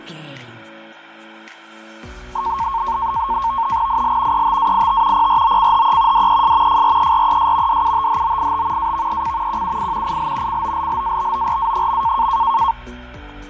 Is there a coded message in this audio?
Yes: NAVTEX (SITOR-B), 100 baud, 170 Hz shift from 2.4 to 12.7 s, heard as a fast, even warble, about 1000 Hz centre, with fading. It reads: IL ETAIT PROCHE DES FRERES DUTHOIT AVEC QUI IL COLLABORA.